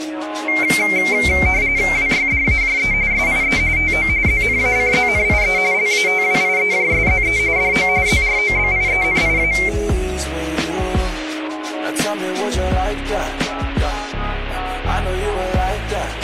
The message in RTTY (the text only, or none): WYDAJE SIE TO ZNACZNIE LATWIEJSZE DO ZROBIENIA